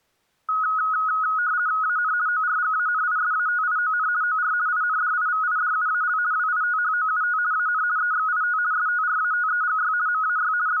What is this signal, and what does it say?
RTTY (50 baud, 170 Hz shift), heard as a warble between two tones, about 1360 Hz centre. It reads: AN ORGANISATION OR INDIVIDUAL WITHOUT AN EXIT STRATEGY MAY …